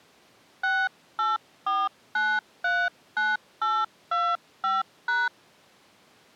DTMF, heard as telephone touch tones, dialled by hand, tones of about 210 ms. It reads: 684939825#